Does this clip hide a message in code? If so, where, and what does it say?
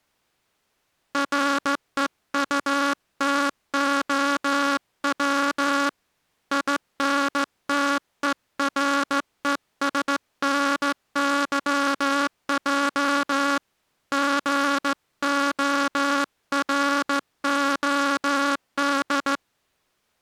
Yes: Morse code (Russian alphabet) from 1.1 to 19.4 s, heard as a buzzer, hand-sent with a straight key, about 15 wpm. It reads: РЕУТОВ ИНТЕРЕСНЫЙ ГОРОД